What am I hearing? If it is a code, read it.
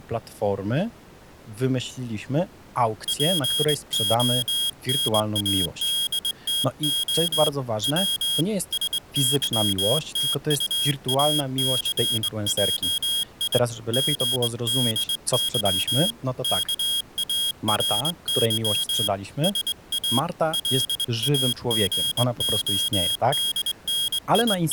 Morse code, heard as a high beeper, hand-sent with a straight key, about 22 wpm, 3250 Hz, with speech in Polish. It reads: PONADTO W SYTUACJI GDY KARY SA …